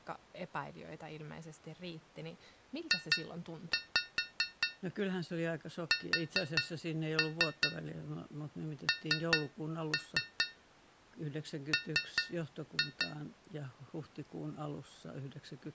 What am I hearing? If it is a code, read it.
Tap code, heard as taps on a metal pipe, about 4 knocks a second, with speech in Finnish. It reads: JSNM